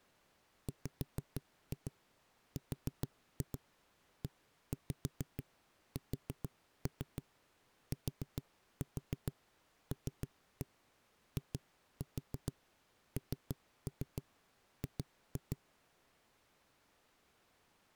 Tap code, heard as knocks on a wall, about 6 knocks a second. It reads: WRESTLING